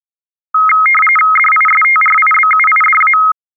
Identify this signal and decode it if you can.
RTTY (45.45 baud, 850 Hz shift), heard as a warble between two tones, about 1700 Hz centre. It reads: DISTRIBUIDA